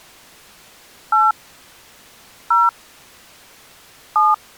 DTMF, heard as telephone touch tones, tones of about 190 ms. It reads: 8 0 7